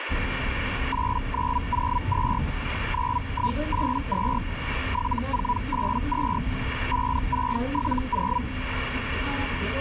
Hellschreiber (Feld-Hell, 122.5 baud), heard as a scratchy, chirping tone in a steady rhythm, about 980 Hz, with radio static and the noise inside a bus. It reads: 8902 9182 7482 5670